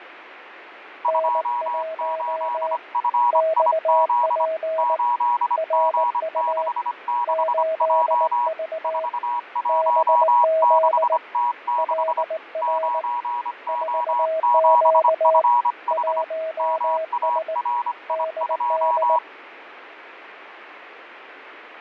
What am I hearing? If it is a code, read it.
Morse code, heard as two keyed tones, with radio static and fading. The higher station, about 25 wpm, 960 Hz: 28FIZ 8G66J 416T6 9O7FH MARI2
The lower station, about 19 wpm, 640 Hz: N1 XP RU 8V BZ LR 4Q 1S DD